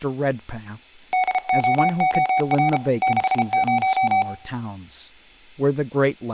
Morse code, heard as a keyed tone, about 33 wpm, 750 Hz, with room echo and speech in English. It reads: DOOR 60